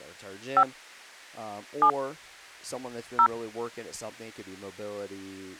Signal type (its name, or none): DTMF